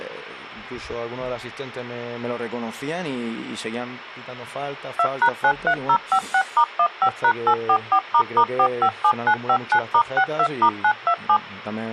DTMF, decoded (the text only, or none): 2#93056*15#844**457959*62*927